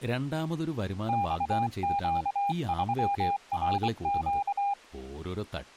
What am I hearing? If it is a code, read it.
Morse code, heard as a keyed tone, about 24 wpm, 800 Hz, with speech in Malayalam. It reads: XQ3RQ